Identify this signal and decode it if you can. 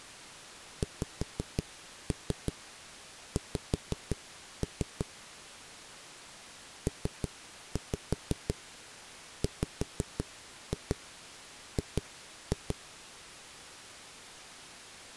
Tap code, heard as knocks on a wall, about 5 knocks a second. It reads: XX PWG